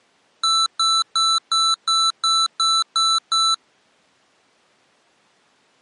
Beep code, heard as beeps from a small speaker, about 1330 Hz. 9 short. In AMI BIOS tables: ROM checksum failure.